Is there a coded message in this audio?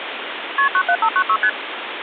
Yes: multi-frequency trunk signalling (R1, as on North American trunks) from 0.6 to 1.5 s, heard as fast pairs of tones, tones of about 70 ms, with phone line noise. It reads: KP 97596 ST